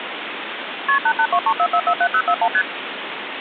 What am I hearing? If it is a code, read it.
Multi-frequency trunk signalling (R1, as on North American trunks), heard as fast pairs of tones, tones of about 70 ms, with phone line noise. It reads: KP 88234447041 ST